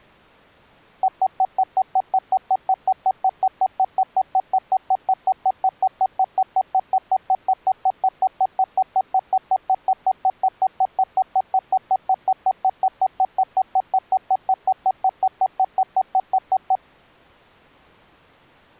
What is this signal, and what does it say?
Evenly repeated beeps. There is no code.